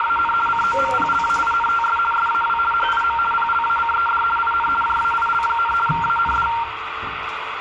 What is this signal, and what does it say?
RTTY (50 baud, 450 Hz shift), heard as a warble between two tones, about 1150 Hz centre, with radio static and the noise inside a lift. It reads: … COMPLAINTS SAW HIM PLACED IN JAIL, AND